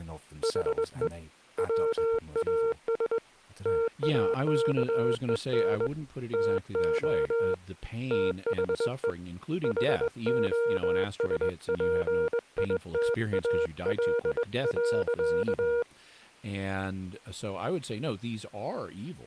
Morse code, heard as a keyed tone, hand-sent with a straight key, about 21 wpm, 460 Hz, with speech in English. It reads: HE WAS TAKEN TO THE HOSPITAL.